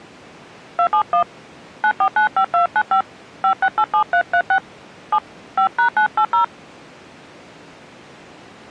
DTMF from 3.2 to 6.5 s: 5687336 7 5#980

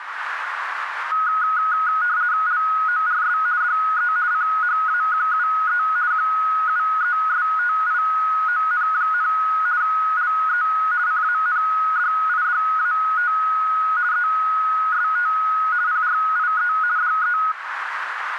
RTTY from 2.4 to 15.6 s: LORS DE CHAQUE QUESTION, LE CANDIDAT EST

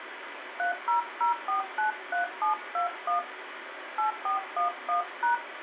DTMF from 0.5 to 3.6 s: 300493721

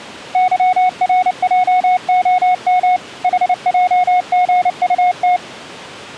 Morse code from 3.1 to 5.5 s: HJGUT

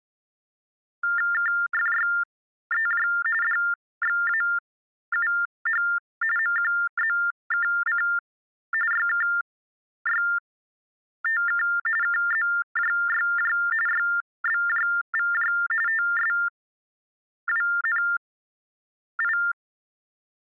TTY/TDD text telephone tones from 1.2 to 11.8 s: KFYEJ DXAUH MQZKC YKYTK

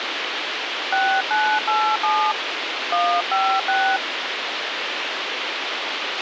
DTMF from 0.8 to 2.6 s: 6987

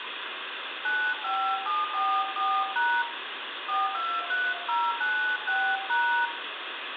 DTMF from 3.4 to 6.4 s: 423096#

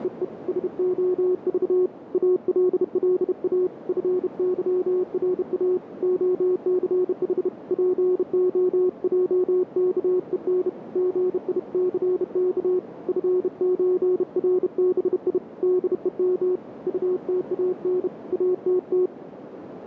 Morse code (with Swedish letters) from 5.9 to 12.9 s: OCH POJKEN GICK

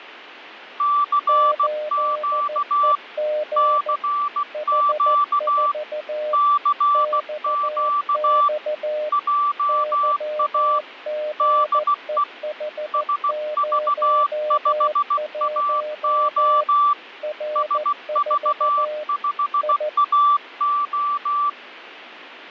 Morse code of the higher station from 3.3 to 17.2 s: CQ CQ JA DE SV5AO

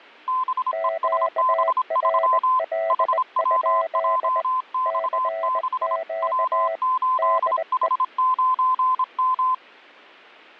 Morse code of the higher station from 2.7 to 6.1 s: HWJX6

